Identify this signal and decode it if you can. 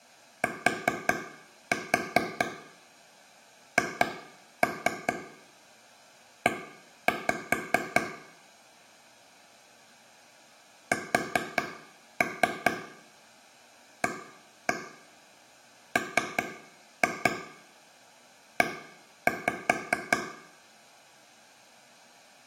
Tap code, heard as taps on a table, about 4 knocks a second, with room echo. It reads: THE SAME